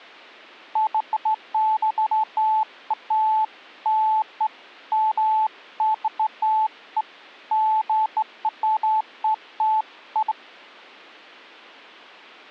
Beeps of irregular length. There is no code.